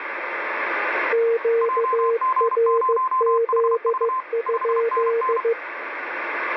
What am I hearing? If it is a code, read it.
Morse code, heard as two keyed tones, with radio static. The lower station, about 15 wpm, 460 Hz: QRZ?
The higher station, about 32 wpm, 1040 Hz: JG0HV 5NN